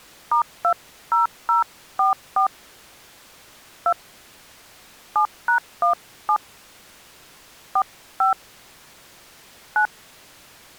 DTMF, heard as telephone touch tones, dialled by hand, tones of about 100 ms. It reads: *20044 2 7#17 45 9